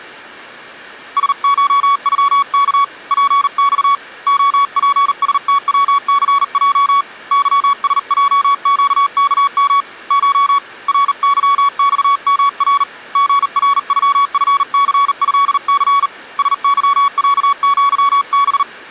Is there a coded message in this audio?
Yes: Morse code (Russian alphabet) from 1.1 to 18.7 s, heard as a keyed tone, hand-sent with a bug key, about 39 wpm, 1120 Hz. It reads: СШЮК ПЬ ОПСТВЦЙ ЫСЙЩКМ Ш РЫЬМР ГРЮФЦЭЦ СЫЯЪБ